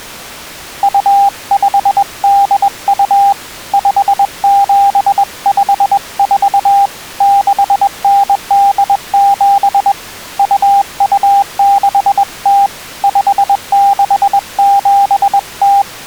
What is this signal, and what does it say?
Morse code (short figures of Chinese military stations), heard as a keyed tone, hand-sent with a bug key, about 21 wpm, 800 Hz. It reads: 2582 5754 6987 2260 5670